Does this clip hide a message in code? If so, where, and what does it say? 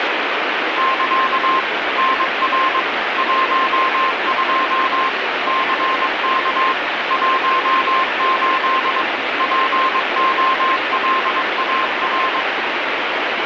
Yes: Morse code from 0.7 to 12.5 s, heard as a keyed tone, machine-sent, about 22 wpm, 1050 Hz, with heavy radio static. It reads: <KA> NR 12 CK 18 POLAR